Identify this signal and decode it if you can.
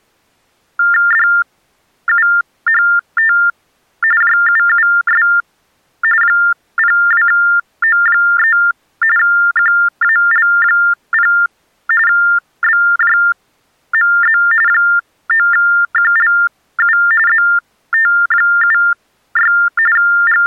TTY/TDD text telephone tones (45.45 baud Baudot), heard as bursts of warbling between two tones, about 400 Hz shift, 1600 Hz centre. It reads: DUHT JUUS 02O3 QAL0 BJMZ 9QLU ZT76 …